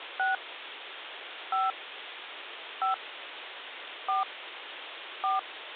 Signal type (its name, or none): DTMF